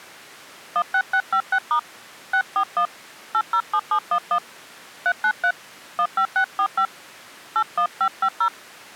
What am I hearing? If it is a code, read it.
DTMF, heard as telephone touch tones, dialled by hand, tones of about 70 ms. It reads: 16656* 641 807711 393 15645 81550